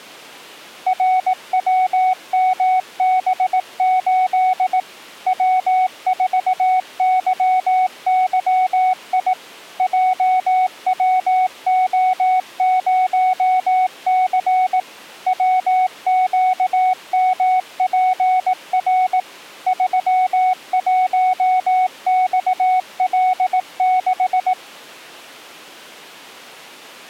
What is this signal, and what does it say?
Morse code, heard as a keyed tone, machine-sent, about 18 wpm, 740 Hz. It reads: RWMB8 W4YYI JWO0C WQMPR 31XL6